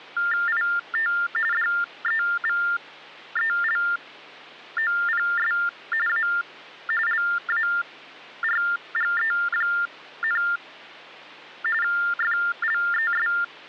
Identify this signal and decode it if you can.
TTY/TDD text telephone tones (45.45 baud Baudot), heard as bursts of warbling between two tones, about 400 Hz shift, 1600 Hz centre, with hum. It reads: IT DEVELOPS A LARGE, …